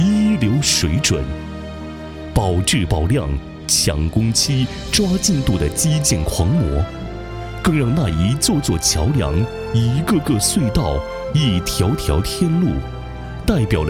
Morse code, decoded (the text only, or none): none